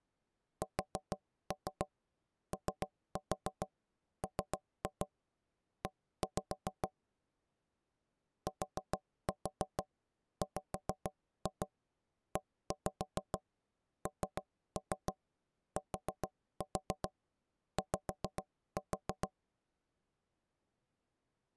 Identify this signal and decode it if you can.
Tap code, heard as knocks on wood, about 6 knocks a second. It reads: SOME TWENTY